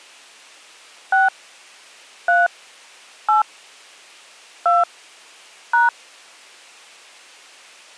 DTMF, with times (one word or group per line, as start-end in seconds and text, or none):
1.1-1.3 6
2.3-2.5 3
3.3-3.4 8
4.7-4.8 2
5.7-5.9 #